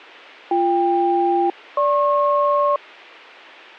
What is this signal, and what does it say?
Aircraft SELCAL, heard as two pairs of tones. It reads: BK-GP